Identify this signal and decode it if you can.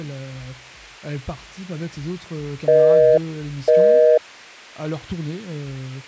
Telephone call progress tone (North American plan), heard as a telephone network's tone, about 480, 620 Hz, 0.5 s on and 0.5 s off. Busy tone.